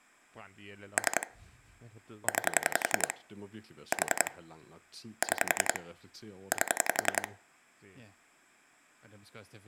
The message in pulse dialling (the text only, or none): 3 9 4 6 8